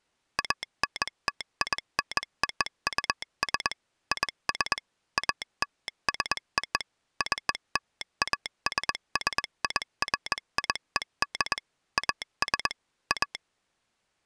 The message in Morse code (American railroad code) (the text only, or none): ANTINOUS IS ALSO CLASSIFIED AS A